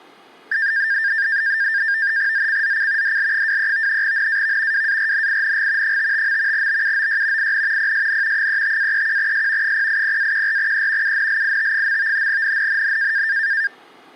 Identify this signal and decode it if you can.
NAVTEX (SITOR-B), 100 baud, 170 Hz shift, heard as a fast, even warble, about 1700 Hz centre. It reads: ZCZC DL23 NAV WARNING 55. BUOY IN PSN 35-31S 080-14E UNLIT. NNNN